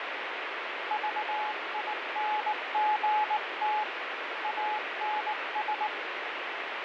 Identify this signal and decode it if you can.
Morse code, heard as a keyed tone, hand-sent with a bug key, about 19 wpm, 850 Hz, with heavy radio static. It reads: VINGT ANS